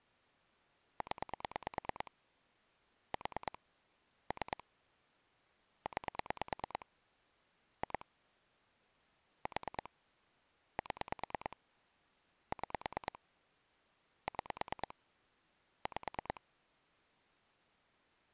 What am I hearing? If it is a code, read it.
Pulse dialling, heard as clicks on a phone line, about 9 pulses a second. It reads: 0 4 3 9 2 4 7 6 6 5